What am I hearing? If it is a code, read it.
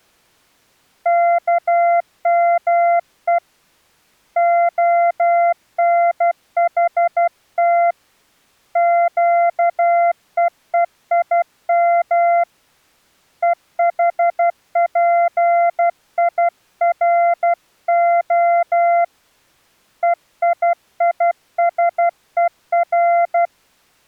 Morse code (Hebrew alphabet), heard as a keyed tone, hand-sent with a paddle, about 12 wpm, 690 Hz. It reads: כמו הנחת קווים וחפירה ויישור